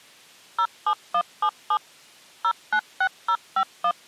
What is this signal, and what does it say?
DTMF, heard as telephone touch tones, dialled by machine, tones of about 70 ms. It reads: 07177 096051